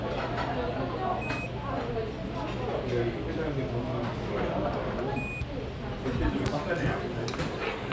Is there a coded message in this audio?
Yes: Quindar tones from 1.2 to 5.4 s, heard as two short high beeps, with radio hiss and the noise of a restaurant.